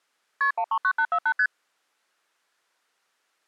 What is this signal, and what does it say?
Multi-frequency trunk signalling (R1, as on North American trunks), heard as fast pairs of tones, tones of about 70 ms. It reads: KP 139848 ST